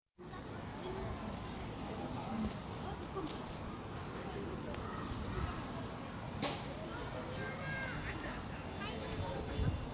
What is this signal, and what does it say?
The noise of a residential street. There is no code.